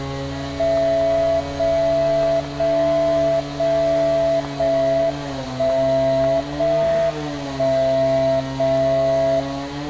Radio time signal (JJY), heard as a tone whose level steps once a second, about 660 Hz, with static crashes and street noise. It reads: 0 0 0 0 1 0 1 0 0